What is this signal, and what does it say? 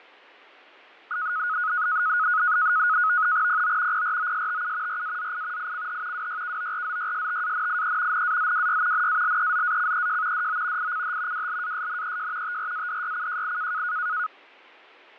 NAVTEX (SITOR-B), 100 baud, 170 Hz shift, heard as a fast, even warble, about 1360 Hz centre, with fading. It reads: PO PROSTU RAZI ICH WYKORZYSTANIE NAZWY NALEZACEJ DO ICH WLASNEJ TRADYCJI